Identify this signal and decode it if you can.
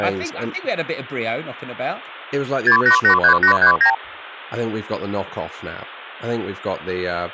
Multi-frequency trunk signalling (R2, with the far end's replies), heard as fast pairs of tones, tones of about 100 ms, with speech in English. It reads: 6883839